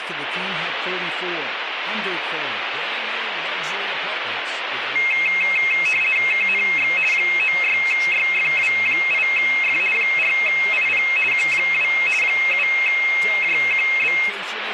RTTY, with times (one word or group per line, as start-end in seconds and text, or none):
6.3-6.9 KNX
7.1-9.8 96YFW8F
9.9-11.0 4IP
11.3-11.9 Q2
12.2-14.1 7JQB